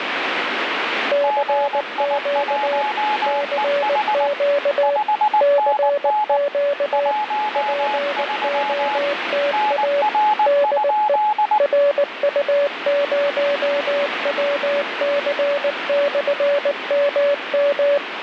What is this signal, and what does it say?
Morse code, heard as two keyed tones, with radio static. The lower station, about 19 wpm, 570 Hz: CQ CQ CQ POTA DE RU0WC/MM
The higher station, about 19 wpm, 850 Hz: GI1EH 5NN 13 NR?